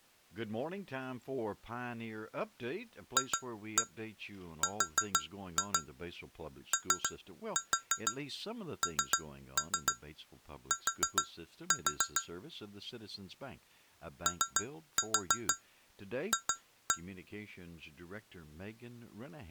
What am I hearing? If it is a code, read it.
Tap code, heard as taps on glass, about 6 knocks a second, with speech in English. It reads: FRONT OF